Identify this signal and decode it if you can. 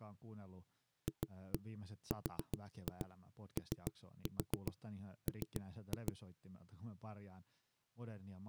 Tap code, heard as knocks on a wall, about 7 knocks a second, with speech in Finnish. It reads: FROM